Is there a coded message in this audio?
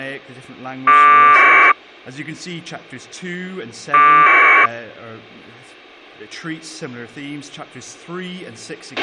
Yes: packet radio (AX.25, as in APRS), 1200 baud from 0.9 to 4.7 s, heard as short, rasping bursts, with a squelch burst at the end.